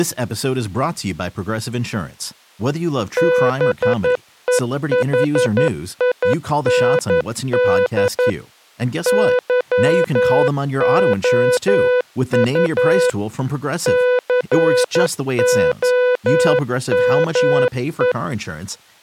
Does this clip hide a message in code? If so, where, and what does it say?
Yes: Morse code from 3.1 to 18.2 s, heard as a keyed tone, machine-sent, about 11 wpm, 500 Hz, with speech in English. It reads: BEHIND YOU COME